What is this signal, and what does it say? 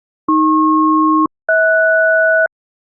Aircraft SELCAL, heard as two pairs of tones. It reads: AP-HS